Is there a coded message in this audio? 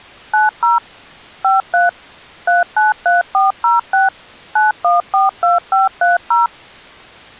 Yes: DTMF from 0.3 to 6.5 s, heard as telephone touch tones, dialled by machine, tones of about 160 ms. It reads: 90 53 393406 9142530